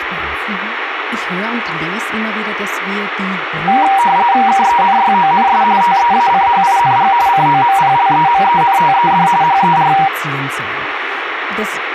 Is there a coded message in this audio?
Yes: RTTY (45.45 baud, 170 Hz shift) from 3.7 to 10.1 s, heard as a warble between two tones, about 870 Hz centre, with radio static and speech in German. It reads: KENYONS TEACHING COMPLEMENTED HER